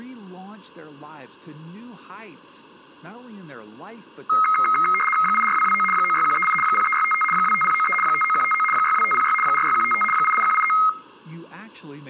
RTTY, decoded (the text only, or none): 84229 96138 03655 25093 59159 62506 46155 88189